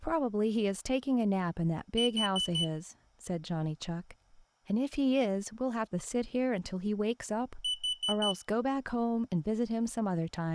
Alarm pattern, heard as an alarm's beeps, played twice, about 3000 Hz, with speech in English. Temporal four. Carbon monoxide.